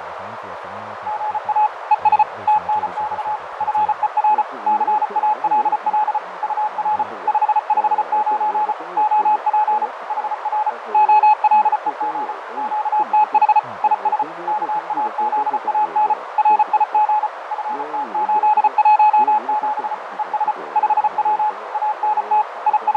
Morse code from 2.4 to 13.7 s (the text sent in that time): TNX FER CALL UR 559 OP HR OLEG QTH